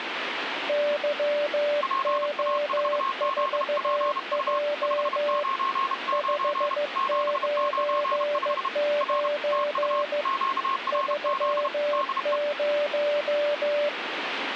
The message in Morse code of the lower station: YO4J 599 30

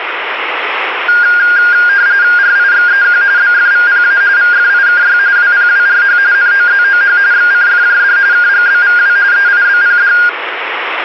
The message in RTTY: RIXEQ BFVPA VFIKY WPWRH NOZOH XCFJD KGBVW EIBPD

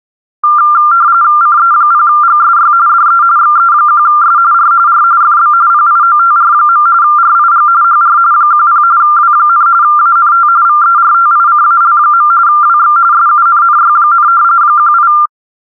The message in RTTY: CE0GSY DE XE1S R R FB PIOTR. RIG HR 10 W, ANT VERTICAL. WX SUNNY, 18

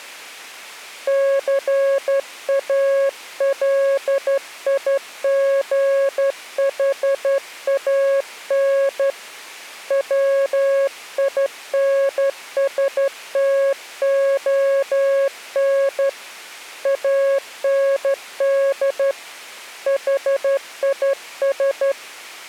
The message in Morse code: CALIGHAN WINSTON AND HIS

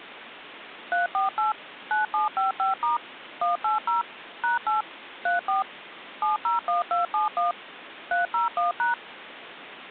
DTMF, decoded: 348 9755* 180 #8 34 701271 301#

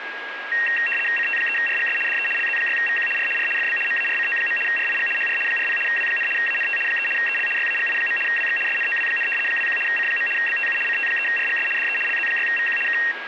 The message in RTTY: CT3RGS DE LZ6VQ R R FB MARCO. RIG HR 40 W, ANT 3 EL YAGI. WX SNOW, 21 C. BTU CT3RGS DE LZ6VQ K

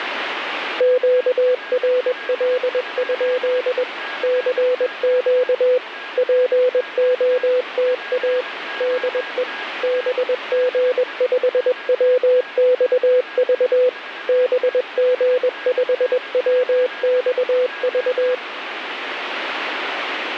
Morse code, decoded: QRL? CQ POTA DE BG5WXV BG5WXV

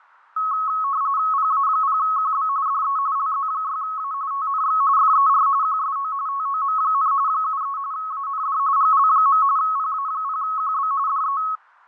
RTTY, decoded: PA0QB DE LZ6A TNX FER QSO TOM, 73 AND GL. PA0QB DE

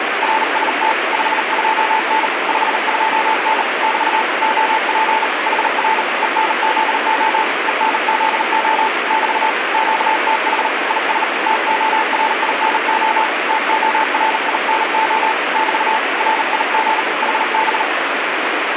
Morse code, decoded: RST 52N 52N <BT> OP HR ENZO ENZO <BT> QTH IS TORINO TORINO <BT> RIG HB

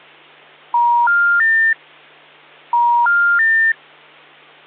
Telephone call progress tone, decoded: special information tone

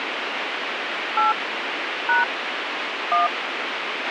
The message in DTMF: 8 # 1

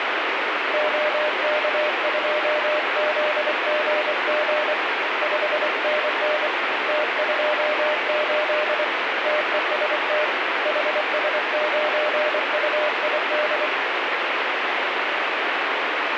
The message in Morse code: OK2ZGG 5NN T28 TEST HS9UID

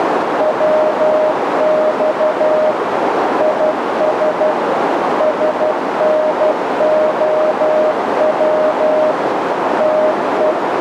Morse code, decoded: WX IS SNOW …

